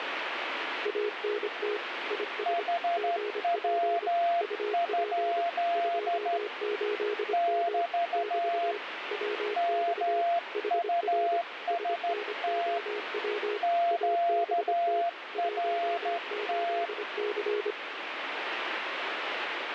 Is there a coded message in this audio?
Yes: Morse code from 0.8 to 17.8 s, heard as two keyed tones, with radio static. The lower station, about 25 wpm, 420 Hz: ANT IS GP UP 28M <BT> WX HR SNOW ABT 18C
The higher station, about 13 wpm, 690 Hz: HW? <BT> MUST QRT